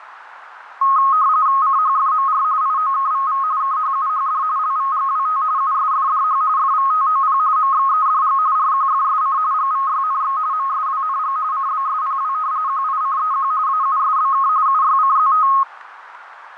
RTTY (45.45 baud, 170 Hz shift), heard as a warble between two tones, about 1170 Hz centre, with radio static. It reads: CHFMR IOKVV KHUHD LVGWT USFDH FVTOP MXEDG RQFSC GVYNX MSWNG CBSPW QICEQ AUSBK UYCZT